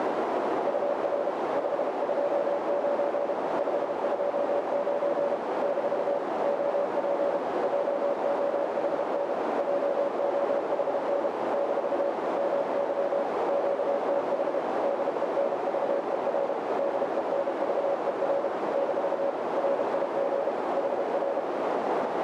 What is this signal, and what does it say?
Morse code, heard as a keyed tone, machine-sent, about 32 wpm, 560 Hz, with heavy radio static and a narrow filter. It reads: UR 529 529 - OP JOHN JOHN - MY QTH DENVER DENVER - RIG HR